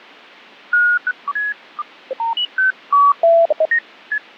Electronic bleeps of random pitch and length, with radio static and fading. There is no code.